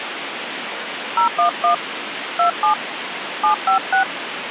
DTMF, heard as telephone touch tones, dialled by hand, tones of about 110 ms, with phone line noise. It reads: 011 27 756